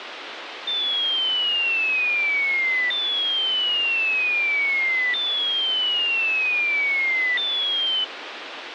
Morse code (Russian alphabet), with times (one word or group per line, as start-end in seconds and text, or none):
none